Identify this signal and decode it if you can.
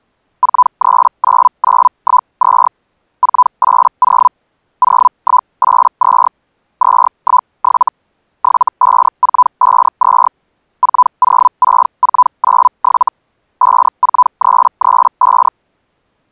Hellschreiber (Feld-Hell, 122.5 baud), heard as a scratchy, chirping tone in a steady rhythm, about 1000 Hz. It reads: 439912 480 0182 217 75452 406497 54335